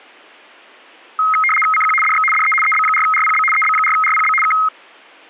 RTTY (75 baud, 850 Hz shift), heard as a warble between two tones, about 1700 Hz centre. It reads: CQ DX DE EB4RPB EB4RPB K